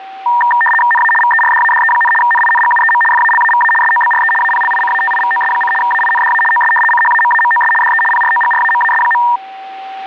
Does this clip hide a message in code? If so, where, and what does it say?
Yes: RTTY (75 baud, 850 Hz shift) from 0.3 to 9.4 s, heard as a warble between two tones, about 1380 Hz centre, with a steady whistle near 770 Hz. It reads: NA VERDADE, NINGUEM FALAVA SOBRE APLICATIVOS: AINDA OS CHAMAMOS DE PROGRAMAS.